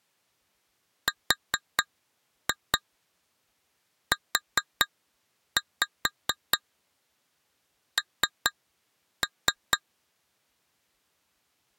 Tap code, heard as taps on glass, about 4 knocks a second. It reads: RUN